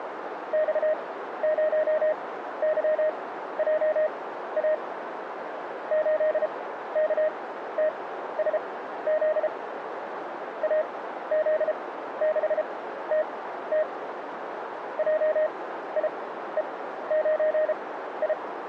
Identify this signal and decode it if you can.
Morse code, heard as a keyed tone, machine-sent, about 33 wpm, spaced as for 14 wpm, 620 Hz, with radio static and a narrow filter. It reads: X0YJA 8KTSZ AZ6TT JIE9I